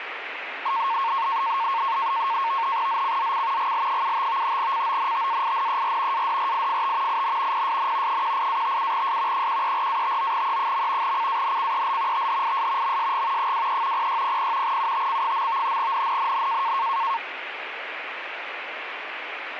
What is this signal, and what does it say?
NAVTEX (SITOR-B), 100 baud, 170 Hz shift, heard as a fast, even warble, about 1000 Hz centre, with radio static. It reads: ZCZC GL75 CONTAINER ADRIFT IN PSN 18-57S 134-59E. CANCEL THIS MSG 23 0600 UTC. NNNN